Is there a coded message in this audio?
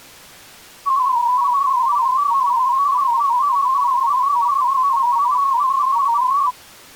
Yes: multi-tone FSK (Olivia or MFSK type), about 250 Hz wide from 0.9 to 6.5 s, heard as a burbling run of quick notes, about 31.25 baud.